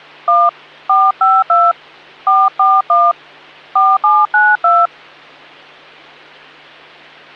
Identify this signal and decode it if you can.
DTMF, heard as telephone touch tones, dialled by hand, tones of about 220 ms, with hum. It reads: 1 452 441 4792